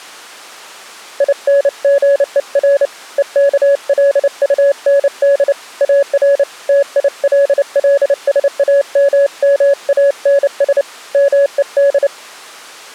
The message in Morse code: INGER EKLUND AR TILLSAMMANS MED

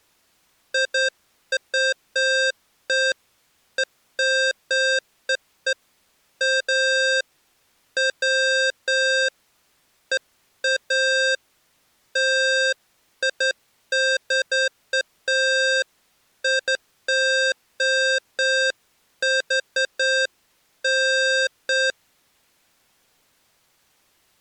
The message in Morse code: none

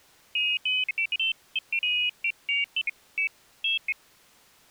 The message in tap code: none

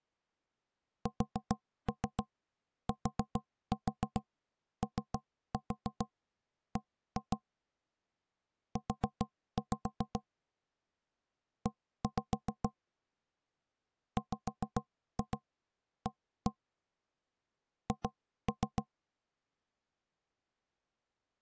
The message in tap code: STOB U E WA H

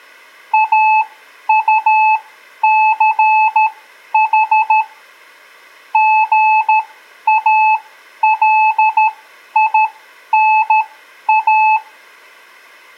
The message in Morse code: AUCH GALINA

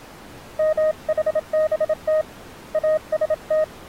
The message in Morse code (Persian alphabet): محبت است

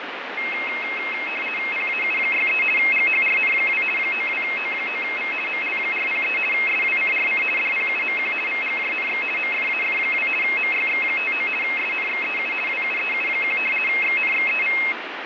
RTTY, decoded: PAU63 GHRN2 92O9V ML403 SWCRC DPUMQ VGJNX MFAF2 MYX59 SNXEU WUEU1 XNXEV

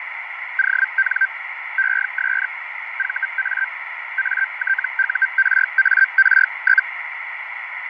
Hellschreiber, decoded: ON ES VA ATURAR?

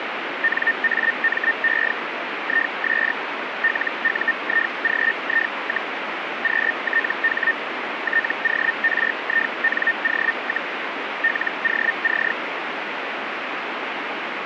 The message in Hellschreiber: NAME IS LUIGI, QTH TORINO, LOC

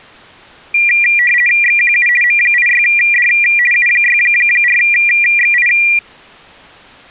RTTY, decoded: XQU M86D U64XI

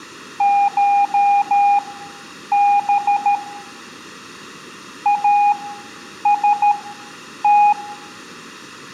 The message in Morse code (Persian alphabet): شب است

